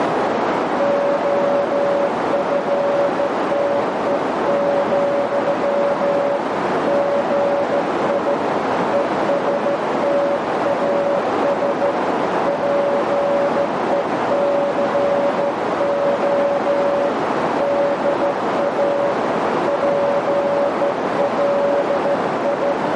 Morse code, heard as a keyed tone, hand-sent with a straight key, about 14 wpm, 570 Hz, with heavy radio static and a narrow filter. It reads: OFTE, GI ESTAS PECO DA PLI